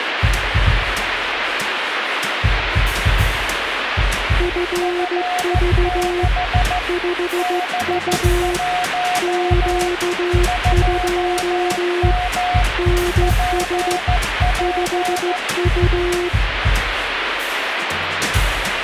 Morse code, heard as two keyed tones, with radio static. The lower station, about 15 wpm, 350 Hz: FV 5U Q2 NS 5U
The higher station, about 14 wpm, 720 Hz: F6 B1 2M PP